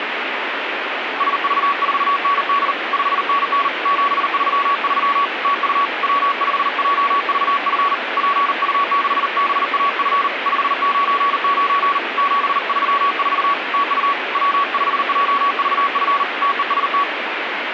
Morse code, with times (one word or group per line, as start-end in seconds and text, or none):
1.2-2.7 SV4ND
2.9-3.7 5NN
3.9-5.3 733
5.4-5.9 TU
6.0-7.9 W5JVF
8.2-10.3 PU6BAF
10.5-12.0 599
12.2-13.5 734
13.7-14.1 TU
14.4-16.2 W5JVF
16.4-17.0 TEST